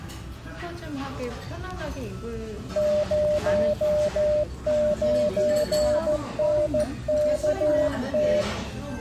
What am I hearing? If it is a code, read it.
Morse code, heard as a keyed tone, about 14 wpm, 600 Hz, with the noise of a restaurant. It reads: 09NKT